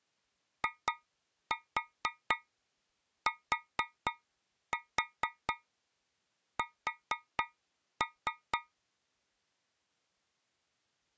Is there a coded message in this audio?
Yes: tap code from 0.6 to 8.7 s, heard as taps on a metal pipe, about 4 knocks a second. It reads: ITS